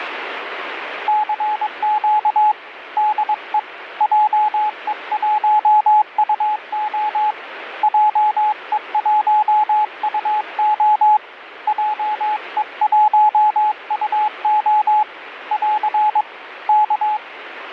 Morse code, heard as a keyed tone, hand-sent with a paddle, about 22 wpm, 850 Hz, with radio static. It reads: CQ DE JE1UO JE1UO JE1UO <AR> K